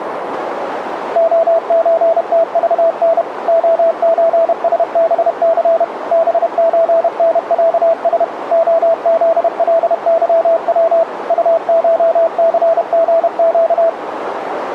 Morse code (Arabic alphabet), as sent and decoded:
--- ---. - ...- -. / --- ---. ... -... -.-. / -... ---. -. .-.- ... / --- --.. .-.. -.-- .-- / ..- ---- -.-. --. --.-
خزتضن خزسبث بزنعس خذلظو طشثغق

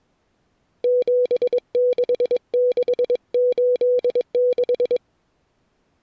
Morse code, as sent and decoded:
--... -.... -.... ---.. -....
76686

